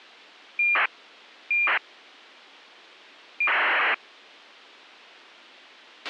ACARS aircraft data, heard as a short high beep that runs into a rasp, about 2400 baud, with a squelch burst at the end.